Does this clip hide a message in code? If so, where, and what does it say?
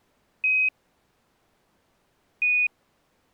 Yes: Quindar tones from 0.4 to 2.7 s, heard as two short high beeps.